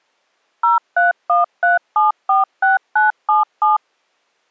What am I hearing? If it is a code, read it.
DTMF, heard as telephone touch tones, dialled by machine, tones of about 150 ms. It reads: 0313746977